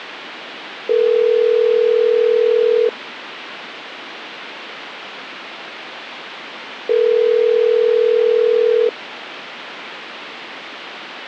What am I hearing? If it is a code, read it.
Telephone call progress tone (North American plan), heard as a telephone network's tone, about 440, 480 Hz, 2 s on and 4 s off. Ringback tone.